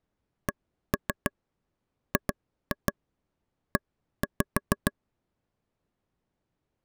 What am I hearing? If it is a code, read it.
Tap code, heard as taps on a table, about 6 knocks a second. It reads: CGE